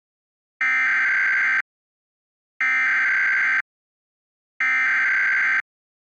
Emergency Alert System (SAME) tones (header bursts), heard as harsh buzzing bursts, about 520.83 baud.